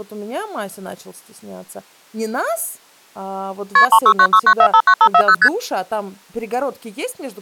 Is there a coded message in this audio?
Yes: multi-frequency trunk signalling (R1, as on North American trunks) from 3.8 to 5.5 s, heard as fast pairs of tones, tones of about 70 ms, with speech in Russian. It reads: KP 36969459540 ST